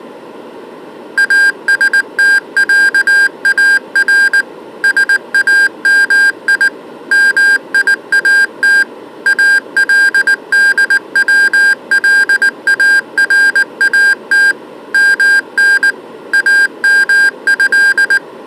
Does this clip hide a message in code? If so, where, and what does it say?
Yes: Morse code (Arabic alphabet) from 1.1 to 18.2 s, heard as electronic beeps, machine-sent, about 19 wpm, 1600 Hz. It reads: استعار سامي ميات الدولارات من امه